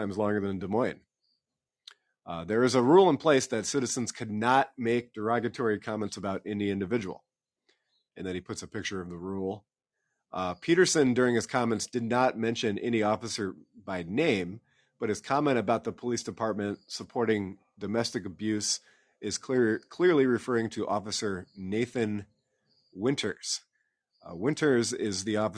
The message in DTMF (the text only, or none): none